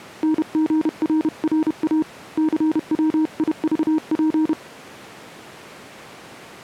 Morse code, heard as a keyed tone, hand-sent with a paddle, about 31 wpm, 310 Hz. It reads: NGRRA CWIVP